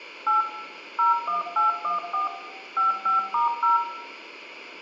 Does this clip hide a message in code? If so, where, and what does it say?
Yes: DTMF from 0.3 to 3.8 s, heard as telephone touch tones, dialled by machine, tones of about 140 ms, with room echo. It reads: 8 01814 55*0